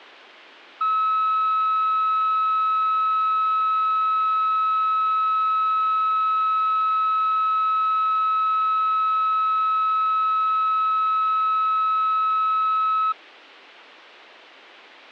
A steady tone. There is no code.